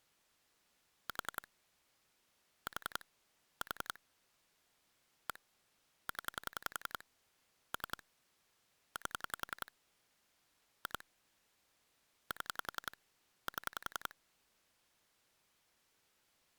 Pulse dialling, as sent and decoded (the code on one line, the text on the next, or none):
4 / 4 / 4 / 1 / 10 / 3 / 8 / 2 / 7 / 7
4 4 4 1 0 3 8 2 7 7